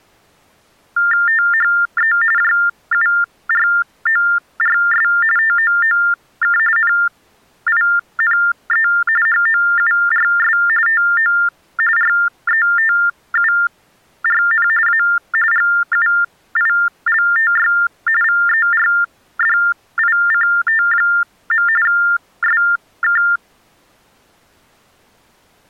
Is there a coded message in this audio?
Yes: TTY/TDD text telephone tones (45.45 baud Baudot) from 1.0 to 23.4 s, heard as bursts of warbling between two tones, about 400 Hz shift, 1600 Hz centre. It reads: THE JURORS TOOK NINE HOURS TO RETURN A GUILTY VERDICT. SK